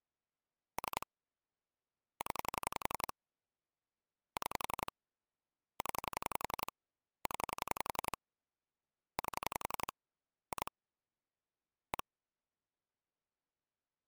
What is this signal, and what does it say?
Pulse dialling, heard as clicks on a phone line, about 11 pulses a second. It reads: 3 0 6 0 0 8 2 1